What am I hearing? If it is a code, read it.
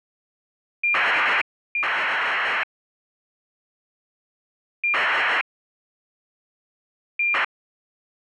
ACARS aircraft data, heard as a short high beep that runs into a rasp, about 2400 baud.